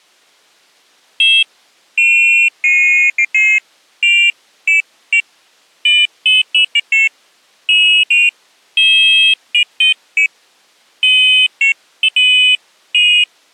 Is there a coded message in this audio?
No, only pairs of high tones at irregular times.